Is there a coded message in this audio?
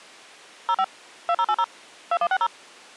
Yes: DTMF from 0.7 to 2.5 s, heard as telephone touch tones, dialled by machine, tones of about 60 ms. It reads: 05 2080 2160